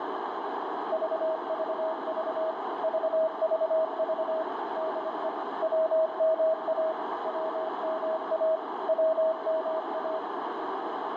Morse code, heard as a keyed tone, machine-sent, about 25 wpm, 640 Hz, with heavy radio static and a narrow filter. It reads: VVV VVV DE WMA WMA WMA